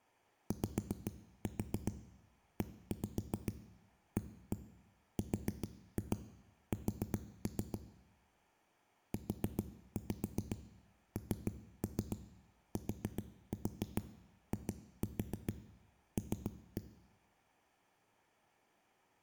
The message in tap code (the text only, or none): YEARS UNTIL